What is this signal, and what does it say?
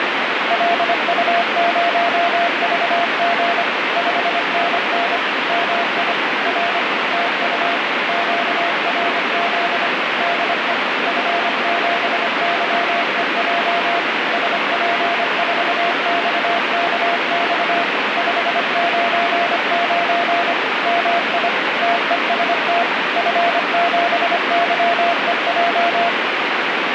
Morse code, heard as a keyed tone, machine-sent, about 25 wpm, 690 Hz, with heavy radio static. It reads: LU0VG 5NN MI R TU QRZ DE F7YEJ SP4XKX 599 MI TEST F7YEJ